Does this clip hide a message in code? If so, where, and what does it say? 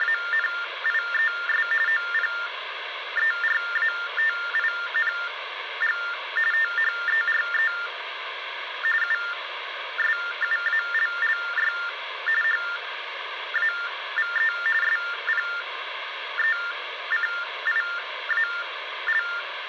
Yes: TTY/TDD text telephone tones (45.45 baud Baudot) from 0.0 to 19.4 s, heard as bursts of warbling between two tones, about 400 Hz shift, 1600 Hz centre, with phone line noise. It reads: … OPERATING THERE USUALLY HAVE SPECIAL